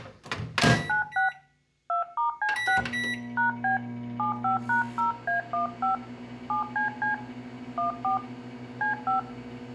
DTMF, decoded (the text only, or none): A96 2*C6 #B 75#0A15 7CC 14 C5